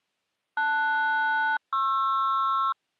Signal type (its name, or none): aircraft SELCAL